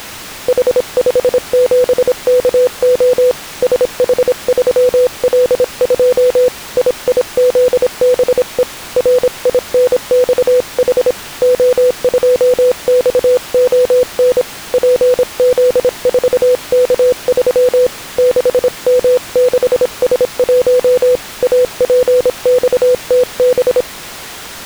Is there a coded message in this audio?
Yes: Morse code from 0.4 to 23.9 s, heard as a keyed tone, hand-sent with a paddle, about 26 wpm, 500 Hz. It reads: H57KO SH3L2 IIZBE RINXH O2XON PZ4K3 6M6S1 APXTB